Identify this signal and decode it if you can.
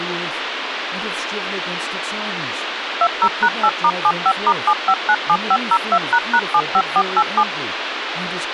DTMF, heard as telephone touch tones, dialled by machine, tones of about 60 ms, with radio hiss and speech in English. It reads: 20#8*75*7597502##75487